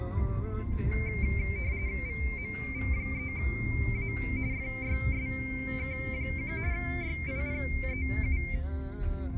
RTTY (45.45 baud, 170 Hz shift), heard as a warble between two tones, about 2200 Hz centre, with the noise inside a car. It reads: VMV3A FYSK1 YIPEU